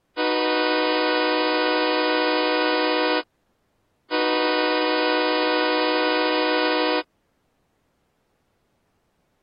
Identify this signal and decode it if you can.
Train horn signal, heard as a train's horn. 2 long. On North American railways: brakes released, proceed.